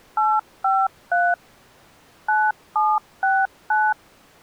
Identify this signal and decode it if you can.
DTMF, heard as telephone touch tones, dialled by machine, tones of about 230 ms. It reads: 853 9769